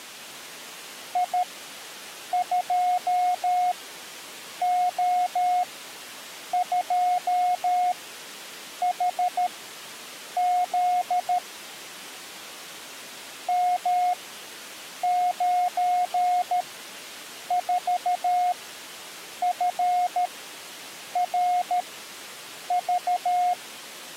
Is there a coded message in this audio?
Yes: Morse code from 1.1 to 23.6 s, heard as a keyed tone, machine-sent, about 13 wpm, spaced as for 7 wpm, 720 Hz. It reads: I2O2HZ M94FRV